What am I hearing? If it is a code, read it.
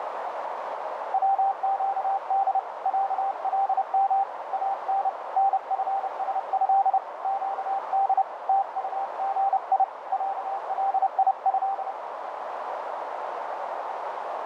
Morse code (Arabic alphabet), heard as a keyed tone, hand-sent with a paddle, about 30 wpm, 790 Hz, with heavy radio static and a narrow filter. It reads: وقد علم ان نفسه قد تطغي عليه